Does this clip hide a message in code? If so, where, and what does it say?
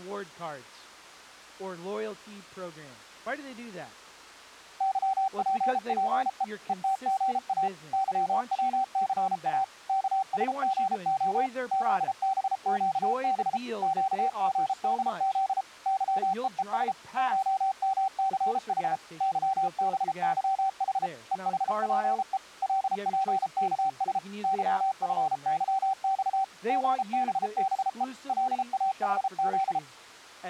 Yes: Morse code (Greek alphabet) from 4.7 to 29.8 s, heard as a keyed tone, machine-sent, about 33 wpm, 770 Hz. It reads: ΥΠΠΕ ΕΤΓΑ ΥΩΘΑ ΚΣΓΟ ΖΒΨΒ ΨΓΔΖ ΥΕΕΣ ΧΜΘΗ ΥΒΥΗ ΕΗΠΕ ΛΠΚΣ ΥΦΥΞ ΓΒΒΕ ΛΑΗΖ